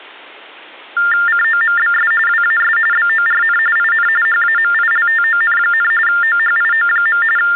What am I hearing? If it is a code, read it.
TTY/TDD text telephone tones (45.45 baud Baudot), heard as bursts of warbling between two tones, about 400 Hz shift, 1600 Hz centre. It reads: COMBS WAS BORN IN HAMILTON, OHIO. …